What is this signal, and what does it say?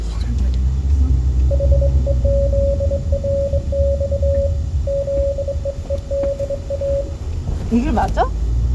Morse code, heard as a keyed tone, hand-sent with a straight key, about 22 wpm, 560 Hz, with room echo and the noise inside a car. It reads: HEZRX ZEEDA